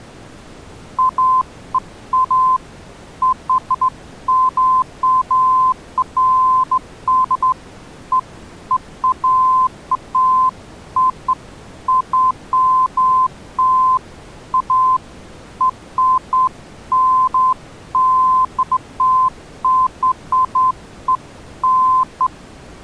Beeps of irregular length. There is no code.